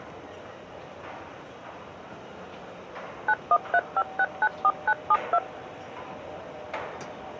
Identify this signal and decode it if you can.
DTMF, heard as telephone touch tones, dialled by machine, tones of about 60 ms, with the noise of a subway station. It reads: 9135694972